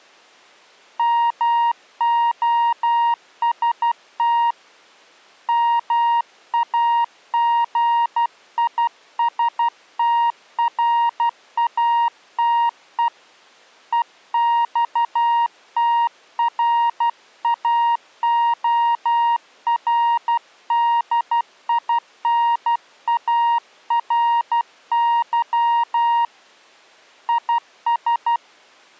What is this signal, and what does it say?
Morse code, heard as a keyed tone, hand-sent with a paddle, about 12 wpm, 940 Hz. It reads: MOST MAGISTRATE EXTRAORDINARY IS